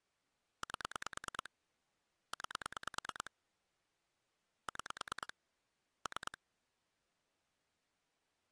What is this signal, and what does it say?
Pulse dialling, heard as clicks on a phone line, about 9 pulses a second. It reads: 8 9 6 3